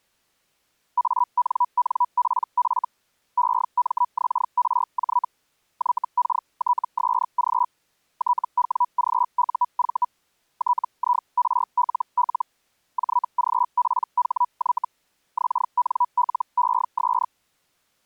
Hellschreiber (Feld-Hell, 122.5 baud), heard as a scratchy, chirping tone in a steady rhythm, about 980 Hz. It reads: ANNPF EMXRJ YKTSG TWGUV TIRLL JGPHY XNLES